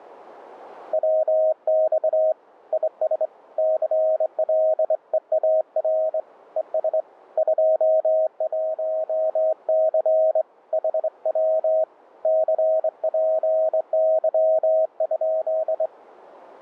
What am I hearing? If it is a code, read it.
Morse code, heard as a keyed tone, hand-sent with a straight key, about 24 wpm, 630 Hz. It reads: WX IS CLEAR ES 21C HW CPY?